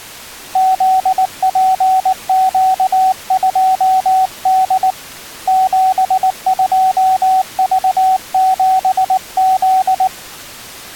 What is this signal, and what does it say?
Morse code, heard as a keyed tone, hand-sent with a paddle, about 19 wpm, 760 Hz. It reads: ZPQ2D 72V7Z